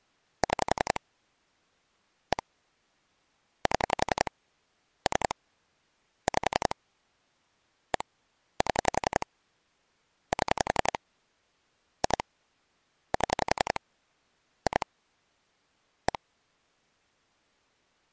Pulse dialling, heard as clicks on a phone line, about 11 pulses a second. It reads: 6 1 7 3 5 1 7 7 2 7 2 1